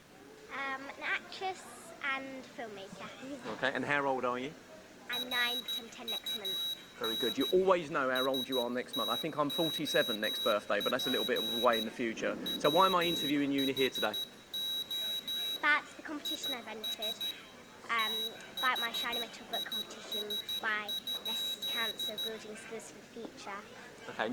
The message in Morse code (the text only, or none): RUN STOP WHO IS THIS?